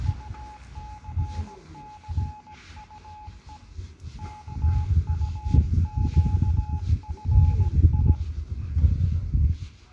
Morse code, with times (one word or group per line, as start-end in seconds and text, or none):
0.1-3.6 UCCUE
4.2-8.1 KUQFI